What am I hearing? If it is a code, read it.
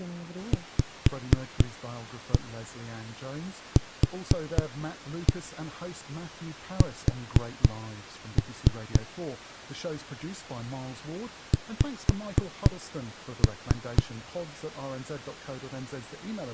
Tap code, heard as knocks on a wall, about 4 knocks a second, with speech in English. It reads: VQS X